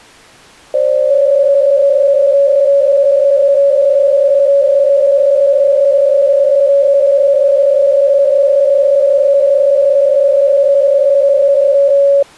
PSK63 (62.5 baud), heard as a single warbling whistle, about 560 Hz.